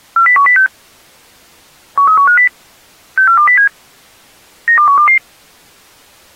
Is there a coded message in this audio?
Yes: five-tone selective call (CCIR) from 0.2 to 5.2 s, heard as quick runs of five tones, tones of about 100 ms. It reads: 40106 13150 64207 92122